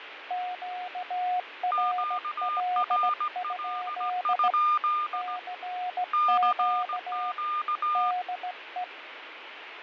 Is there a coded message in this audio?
Yes: Morse code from 0.2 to 8.9 s, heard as two keyed tones, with radio static and fading. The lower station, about 17 wpm, 720 Hz: QRL? CQ DE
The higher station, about 17 wpm, 1210 Hz: QRL? CQ